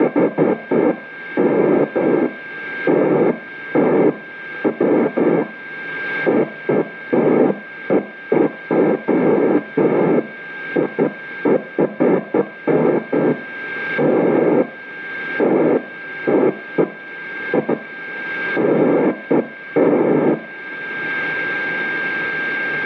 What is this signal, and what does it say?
Bursts of noise, with a steady whistle near 1590 Hz and room echo. There is no code.